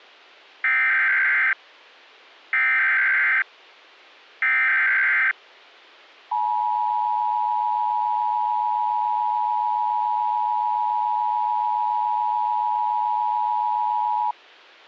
Emergency Alert System (SAME) tones (header bursts, then the 853 and 960 Hz attention tone), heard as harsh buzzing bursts, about 520.83 baud.